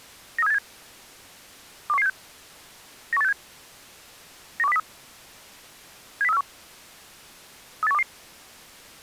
Five-tone selective call (EEA), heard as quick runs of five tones, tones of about 40 ms. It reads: 93787 21176 91867 91203 70341 38122